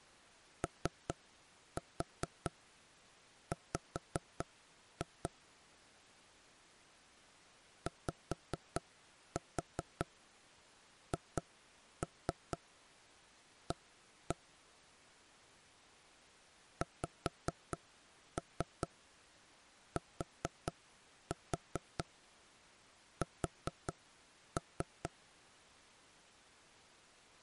Tap code, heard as knocks on wood, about 4 knocks a second. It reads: OW YHA XTS